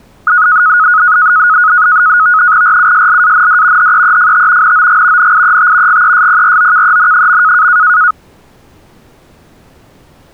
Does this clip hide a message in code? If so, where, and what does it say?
Yes: NAVTEX (SITOR-B), 100 baud, 170 Hz shift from 0.3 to 8.1 s, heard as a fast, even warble, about 1360 Hz centre. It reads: RUSLAND HEEFT NOG NIET GESPROKEN.